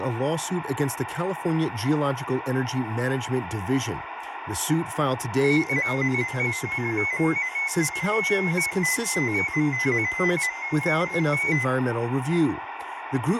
Multi-tone FSK (Olivia or MFSK type), about 250 Hz wide, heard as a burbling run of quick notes, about 15.625 baud, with radio static, room echo and speech in English.